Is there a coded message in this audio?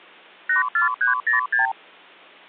Yes: multi-frequency trunk signalling (R2, with the far end's replies) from 0.5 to 1.7 s, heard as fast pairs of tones, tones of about 130 ms. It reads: 84306